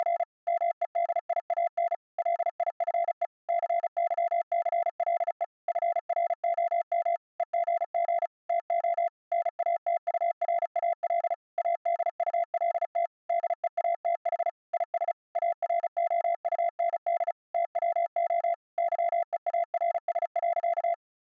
Morse code, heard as a keyed tone, machine-sent, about 35 wpm, 680 Hz. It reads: … MEDIAN LIFE CYCLE FROM EGG TO NATURAL ADULT DEATH IS AROUND TWO YEARS.